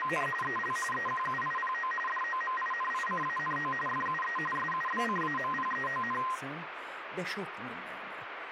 RTTY (45.45 baud, 850 Hz shift), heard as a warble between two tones, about 1460 Hz centre, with radio static and speech in Hungarian. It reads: … EL EQUIPO DOMINICANO FUE SUBCAMPEON